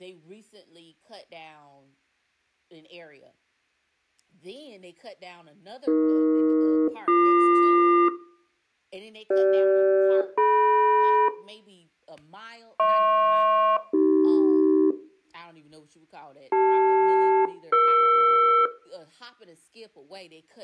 Aircraft SELCAL, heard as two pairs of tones, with room echo and speech in English. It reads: AE-BQ CG-DM HP-AC CL-ER